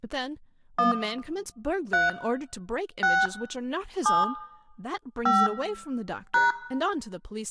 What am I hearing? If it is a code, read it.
DTMF, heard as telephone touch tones, dialled by hand, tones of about 170 ms, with room echo and speech in English. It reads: 1 3 6 7 5 #